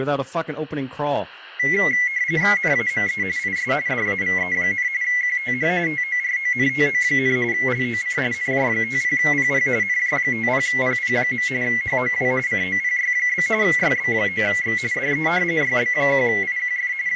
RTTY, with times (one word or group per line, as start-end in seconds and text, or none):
2.6-3.2 NAME
3.4-3.7 IS
3.9-4.9 DAVE,
5.0-5.7 QTH
5.9-7.4 TORONTO,
7.5-8.2 LOC
8.3-9.7 NJ50PP
9.8-11.5 NJ50PP.
11.6-12.3 HOW
12.5-13.5 COPY?
13.6-14.8 YB9X
14.9-15.3 DE
15.6-16.9 YB1IQF
17.1-17.2 …